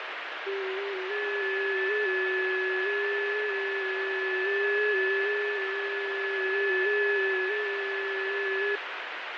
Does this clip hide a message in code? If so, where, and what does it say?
Yes: FT8 (several signals at once) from 0.5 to 8.8 s, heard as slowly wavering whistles, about 6.25 baud, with heavy radio static.